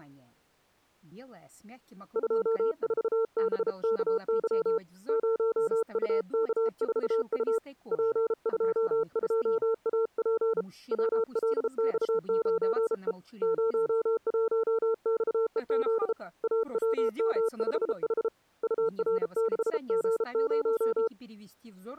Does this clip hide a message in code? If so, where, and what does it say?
Yes: Morse code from 2.1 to 21.1 s, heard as a keyed tone, hand-sent with a bug key, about 33 wpm, 450 Hz. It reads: 24BKY 0UK4U P22AP WLX9E 01XEZ AWM5H UR6G0